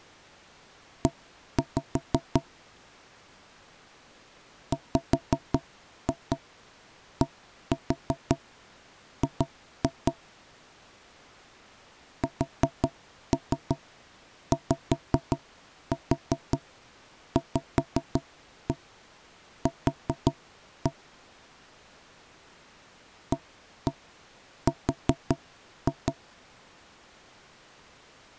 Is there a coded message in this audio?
Yes: tap code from 1.1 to 26.2 s, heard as knocks on wood, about 5 knocks a second. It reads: E WDG SYVQ AR